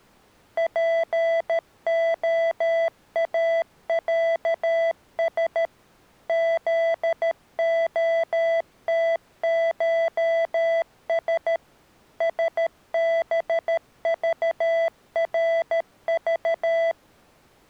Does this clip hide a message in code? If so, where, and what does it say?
Yes: Morse code (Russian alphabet) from 0.5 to 17.0 s, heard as electronic beeps, machine-sent, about 13 wpm, 660 Hz. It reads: ПОАЯС ЗОТШС СБЖРЖ